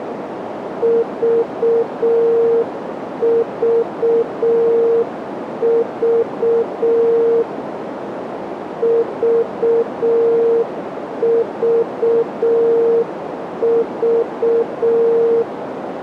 Morse code, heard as a keyed tone, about 6 wpm, 460 Hz, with radio static and a narrow filter. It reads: VVV VVV